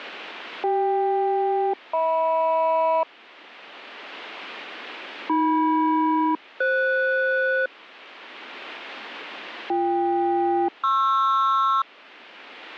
Aircraft SELCAL, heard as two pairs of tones. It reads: CK-HM AM-FS BK-PR